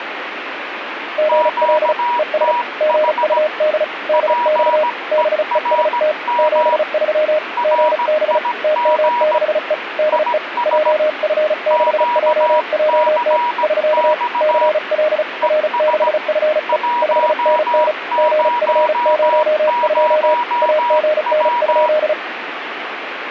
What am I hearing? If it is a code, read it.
Morse code, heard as two keyed tones, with radio static. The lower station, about 35 wpm, 610 Hz: GL ES GUD DX BEST 73 GB TM6E DE JF6JJT <SK> CL R6FE 5NN GF02 AGN?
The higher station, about 17 wpm, 960 Hz: QTH PERM RIG IS QCX ES 100W